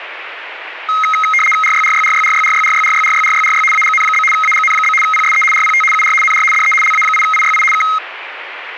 RTTY (75 baud, 850 Hz shift), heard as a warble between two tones, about 1700 Hz centre, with radio static. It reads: RYRYRYRYRYRYRYRYRYRY AGN? AGN? PSE RPT UR NR DE LA8IYI K